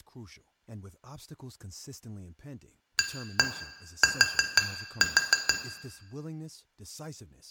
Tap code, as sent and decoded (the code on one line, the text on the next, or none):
1-1 4-4
AT